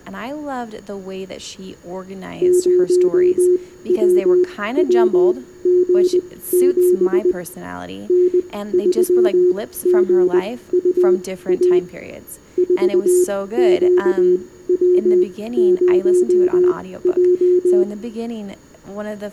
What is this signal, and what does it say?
Morse code, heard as a keyed tone, machine-sent, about 20 wpm, spaced as for 15 wpm, 360 Hz, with room echo and speech in English. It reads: 0WWG7 N3GUA 4QW0J